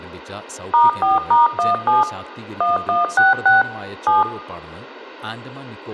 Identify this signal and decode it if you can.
DTMF, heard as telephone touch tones, dialled by machine, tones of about 160 ms, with speech in Malayalam. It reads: *4*17 1166 7